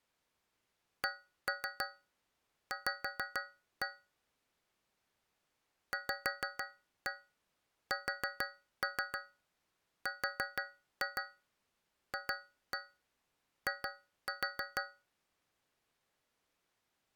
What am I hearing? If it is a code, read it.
Tap code, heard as taps on a metal pipe, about 6 knocks a second. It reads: CV VSRFI